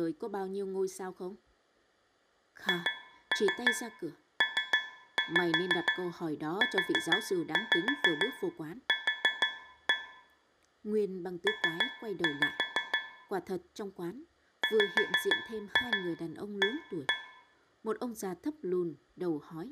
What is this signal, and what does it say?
Tap code, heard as taps on a metal pipe, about 6 knocks a second, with room echo and speech in Vietnamese. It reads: HPUQ P WA